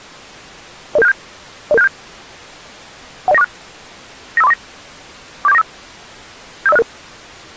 Five-tone selective call (EIA), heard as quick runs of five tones, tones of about 30 ms. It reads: 00767 00767 10946 95349 47495 75066